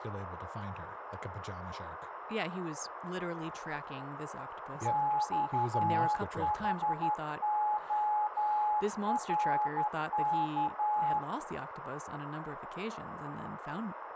Morse code, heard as a keyed tone, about 12 wpm, 840 Hz, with radio static, a narrow filter, room echo and speech in English. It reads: XHORK